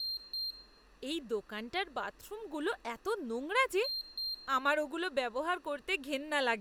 Beep code, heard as a piezo beeper, played twice, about 4200 Hz, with room echo and speech in Bangla. 2 short. In AMI BIOS tables: memory parity error; in IBM BIOS tables: self-test error shown on screen; in Dell tables: no memory detected.